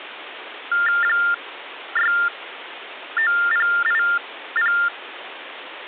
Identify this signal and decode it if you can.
TTY/TDD text telephone tones (45.45 baud Baudot), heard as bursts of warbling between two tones, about 400 Hz shift, 1600 Hz centre, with phone line noise. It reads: 69080